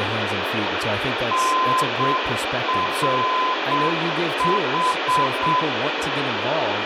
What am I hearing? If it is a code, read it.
Morse code, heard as a keyed tone, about 7 wpm, 1020 Hz, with radio hiss, room echo and speech in English. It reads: NRH